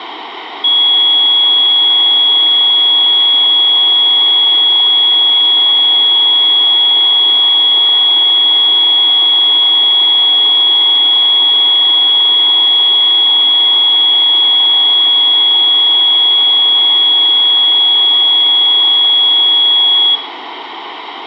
A steady tone, with room echo. There is no code.